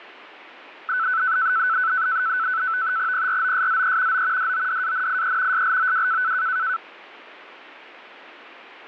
NAVTEX (SITOR-B), 100 baud, 170 Hz shift, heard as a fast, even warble, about 1410 Hz centre. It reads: PROSZE O DODANIE SLOW